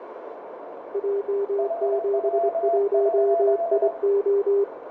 Morse code, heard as two keyed tones, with radio static, a narrow filter and room echo. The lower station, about 24 wpm, 400 Hz: J71IO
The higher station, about 22 wpm, 680 Hz: HW?